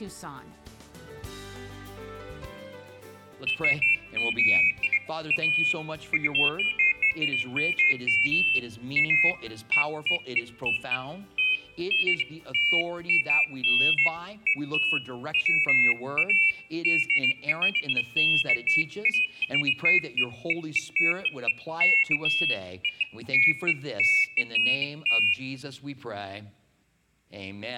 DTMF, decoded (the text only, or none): none